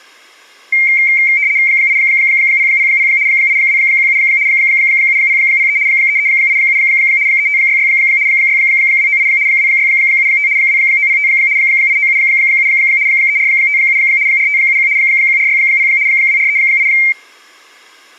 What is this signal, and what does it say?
RTTY (75 baud, 170 Hz shift), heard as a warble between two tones, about 2200 Hz centre. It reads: 8000 8217 7003 3387 3566 6298 2675 2905 8977 3457 4571 1460 2438